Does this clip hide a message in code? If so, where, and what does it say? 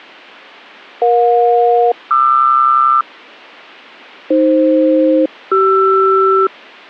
Yes: aircraft SELCAL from 1.0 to 6.5 s, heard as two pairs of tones. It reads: EJ-QR AF-CR